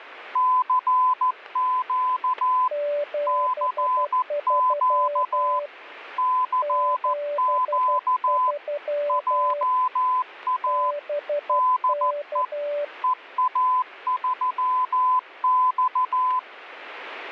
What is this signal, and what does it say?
Morse code, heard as two keyed tones, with static crashes. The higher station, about 14 wpm, 1010 Hz: CQ CQ CQ JA DE EA3X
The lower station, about 12 wpm, 580 Hz: 73 73 BK